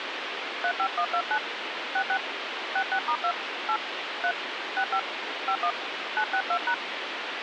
DTMF, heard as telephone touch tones, dialled by hand, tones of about 70 ms, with radio hiss. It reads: 35129 66 66*2 8 3 65 51 962#